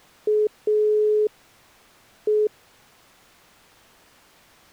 Telephone call progress tone (pulsed, as in Italy), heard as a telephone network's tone, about 420 Hz. Dial tone.